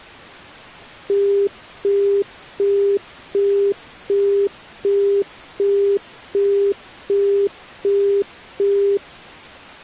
Telephone call progress tone (as in the UK, Australia and similar networks), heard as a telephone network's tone, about 400 Hz, 0.375 s on and 0.375 s off. Busy tone.